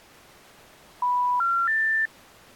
Telephone call progress tone (North American plan), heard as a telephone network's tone, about 980, 1370, 1800 Hz. Special information tone.